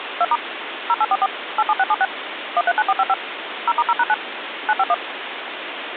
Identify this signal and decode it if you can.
DTMF, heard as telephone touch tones, dialled by machine, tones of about 40 ms, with phone line noise. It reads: 2* 0844 87676 139455 0*0#9 951